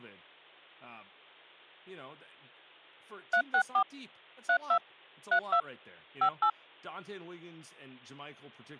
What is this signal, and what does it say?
DTMF, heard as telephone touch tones, dialled by machine, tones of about 80 ms, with hum and speech in English. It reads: 364 32 32 58